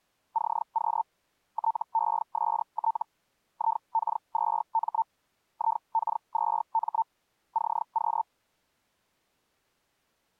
Hellschreiber (Feld-Hell, 122.5 baud), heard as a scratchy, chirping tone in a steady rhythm, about 900 Hz. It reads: CQ TEST IK2M IK2M CQ